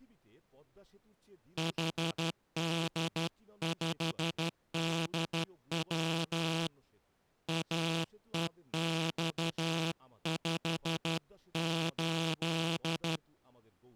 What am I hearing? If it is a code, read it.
Morse code, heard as a buzzer, hand-sent with a straight key, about 12 wpm, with speech in Bangla. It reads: HD5DW AEX58